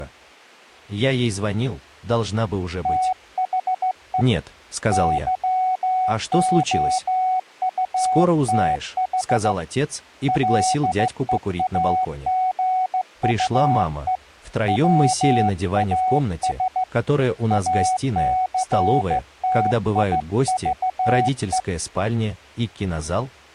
Morse code, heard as a keyed tone, hand-sent with a straight key, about 15 wpm, 740 Hz. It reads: THE YOUTH LEAGUE WAS ACTIVE